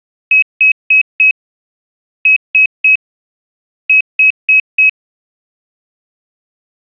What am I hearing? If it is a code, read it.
Beep code, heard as a piezo beeper, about 2550 Hz. 4-3-4. In Phoenix BIOS tables: time-of-day clock failure.